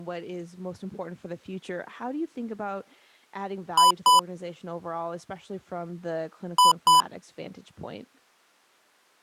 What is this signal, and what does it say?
Beep code, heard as beeps from a small speaker, played twice, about 1000 Hz, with speech in English. 2 short. In AMI BIOS tables: memory parity error; in IBM BIOS tables: self-test error shown on screen; in Dell tables: no memory detected.